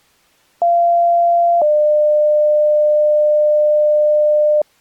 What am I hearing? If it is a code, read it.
Two-tone page, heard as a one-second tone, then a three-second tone, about 690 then 600 Hz.